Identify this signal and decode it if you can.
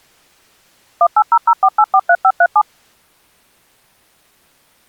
DTMF, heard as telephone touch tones, dialled by machine, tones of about 60 ms. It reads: 18004843537